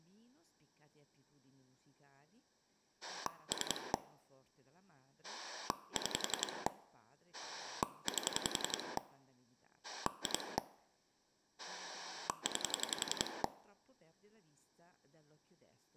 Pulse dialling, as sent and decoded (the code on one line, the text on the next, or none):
3 / 6 / 8 / 2 / 9
3 6 8 2 9